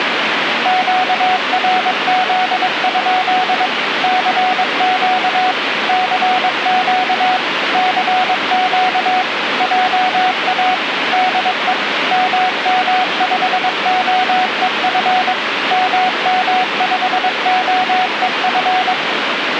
Morse code, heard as a keyed tone, machine-sent, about 22 wpm, 740 Hz, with radio static. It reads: QRZ? CQ CQ CQ JA DE MM5OEF MM5OEF